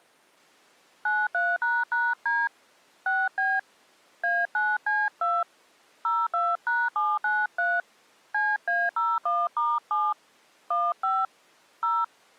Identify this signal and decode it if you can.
DTMF, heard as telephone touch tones, dialled by hand, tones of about 220 ms. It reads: 93##D 6B A9C2 02#793 CA01*7 15 0